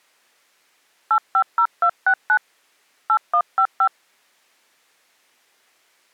DTMF, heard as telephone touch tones, dialled by hand, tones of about 70 ms. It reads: 850269 8155